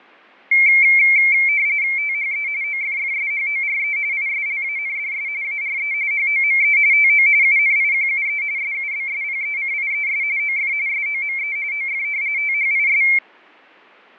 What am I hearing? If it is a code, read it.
RTTY (45.45 baud, 170 Hz shift), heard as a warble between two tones, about 2250 Hz centre, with fading. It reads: THE OFFSHORE ISLANDS ARE HOME TO UNIQUE SUBSPECIES OF SOME OF THIS